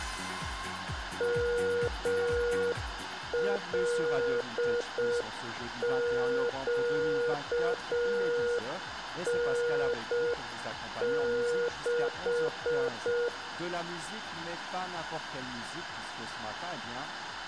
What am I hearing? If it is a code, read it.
Morse code, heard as a keyed tone, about 6 wpm, 480 Hz, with room echo. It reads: MLQN6